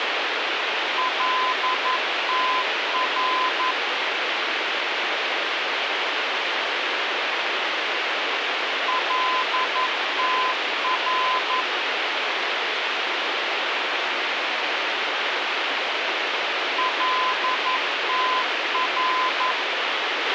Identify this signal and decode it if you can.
Morse code, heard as a keyed tone, machine-sent, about 11 wpm, 1020 Hz, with radio hiss and a squelch burst at the end. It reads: LTR LTR LTR